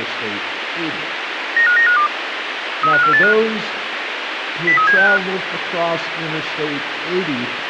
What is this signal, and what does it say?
Five-tone selective call (CCIR), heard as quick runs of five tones, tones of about 100 ms, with radio hiss. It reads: 95952 35485 03765